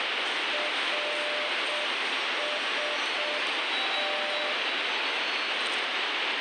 Morse code, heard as a keyed tone, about 6 wpm, 600 Hz, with heavy radio static and the noise of a subway station. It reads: RST